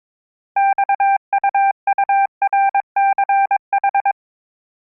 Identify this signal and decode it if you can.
Morse code, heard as a keyed tone, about 22 wpm, 790 Hz. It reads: XUURCH